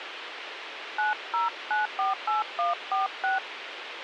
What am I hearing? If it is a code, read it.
DTMF, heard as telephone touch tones, dialled by hand, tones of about 150 ms, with radio hiss. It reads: 90948146